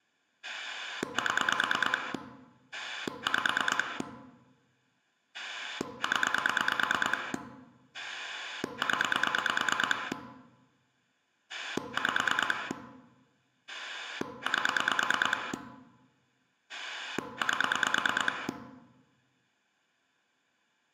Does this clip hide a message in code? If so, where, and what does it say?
Yes: pulse dialling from 0.4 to 18.5 s, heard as a rotary dial, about 9 pulses a second, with room echo. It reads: 7 5 0 0 5 8 8